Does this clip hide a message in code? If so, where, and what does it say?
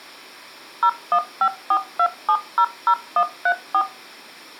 Yes: DTMF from 0.8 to 3.8 s, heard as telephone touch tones, dialled by machine, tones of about 70 ms. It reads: 01542700134